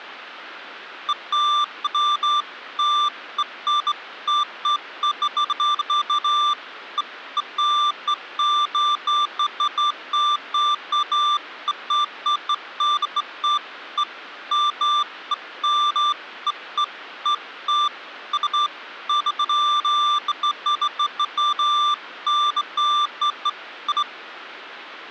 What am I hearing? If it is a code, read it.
Beeps of irregular length. There is no code.